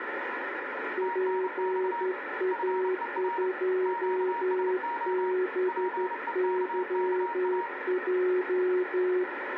Morse code, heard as two keyed tones, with radio static and room echo. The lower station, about 12 wpm, 370 Hz: PA2BYJ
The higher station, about 30 wpm, 940 Hz: TNX FER QSO PEKKA